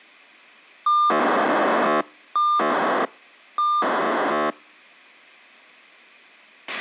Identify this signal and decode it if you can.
POCSAG pager data (2400 baud), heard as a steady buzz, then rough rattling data, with a squelch burst at the end.